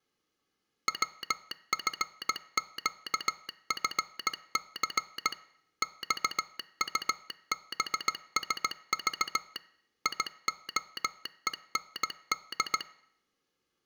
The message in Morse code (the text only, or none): WFQFC XUBSV IOEND